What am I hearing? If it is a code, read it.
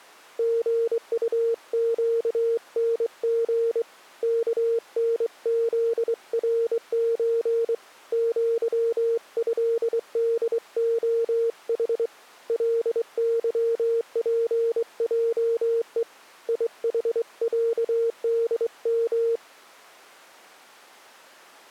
Morse code (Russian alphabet), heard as a keyed tone, hand-sent with a straight key, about 23 wpm, 460 Hz. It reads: ГУЩНГ КНЗРЧ ЪЭДОХ ЛЫПЙЕ ИХЯДМ